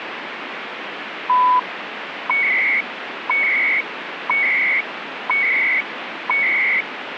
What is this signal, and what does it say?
Radio time signal (CHU, Canada), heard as beeps and data bursts, one a second, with radio static.